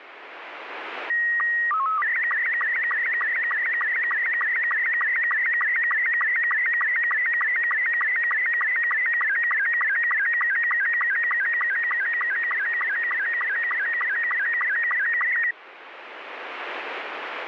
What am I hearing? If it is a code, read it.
SSTV (slow-scan television), Robot 72, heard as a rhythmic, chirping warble, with radio static.